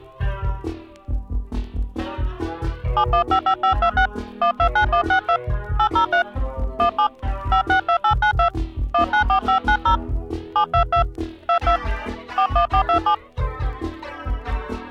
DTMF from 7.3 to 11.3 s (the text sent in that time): 562892 194590 722